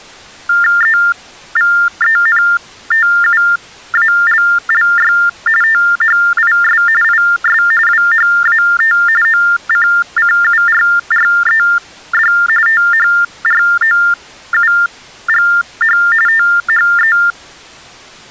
TTY/TDD text telephone tones (45.45 baud Baudot), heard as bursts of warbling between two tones, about 400 Hz shift, 1600 Hz centre. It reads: EVENTUALLY THIS IS WHAT OCCURRED THROUGH THE